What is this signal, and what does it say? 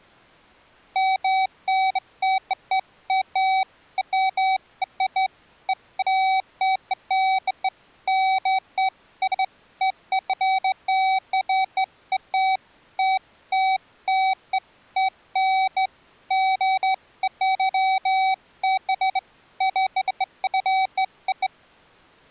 Beeps of irregular length. There is no code.